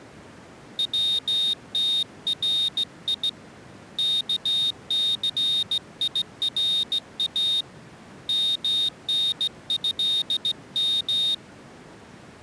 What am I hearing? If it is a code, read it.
Morse code (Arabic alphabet), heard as a high beeper, hand-sent with a straight key, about 16 wpm, 3700 Hz. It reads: وتري كثيرا منهم